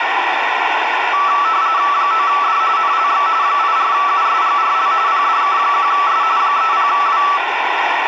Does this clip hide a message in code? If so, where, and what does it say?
Yes: RTTY (45.45 baud, 170 Hz shift) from 1.1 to 7.4 s, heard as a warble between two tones, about 1230 Hz centre, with radio static and room echo. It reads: 9D NLX 84USGRL PDK1S 30W